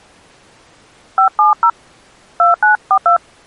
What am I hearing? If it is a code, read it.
DTMF, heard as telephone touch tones, dialled by hand, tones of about 110 ms. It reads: 570 2942